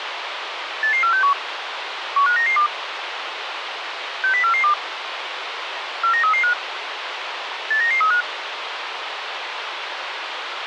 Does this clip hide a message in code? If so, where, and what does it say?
Yes: five-tone selective call (CCIR) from 0.8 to 8.2 s, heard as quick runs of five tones, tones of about 100 ms, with radio hiss. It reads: 88461 15992 60442 49335 89935